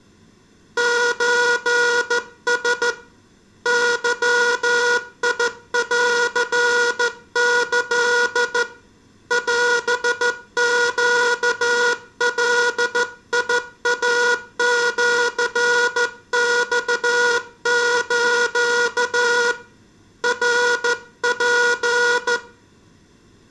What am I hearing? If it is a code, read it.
Morse code (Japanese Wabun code), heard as a buzzer, hand-sent with a straight key, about 14 wpm, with room echo. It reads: ソラ ゲンキ オネガイシマス ナツ